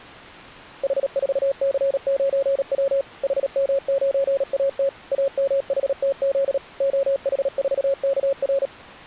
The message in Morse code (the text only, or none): H4C9W HM9AT AMHTZ OH4KR